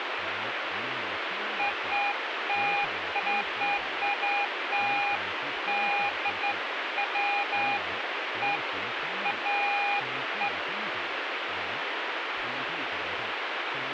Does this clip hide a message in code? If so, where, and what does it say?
No, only beeps of irregular length, with radio static.